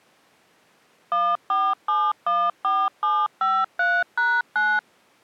DTMF, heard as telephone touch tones, dialled by machine, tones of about 240 ms. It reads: 14714753#9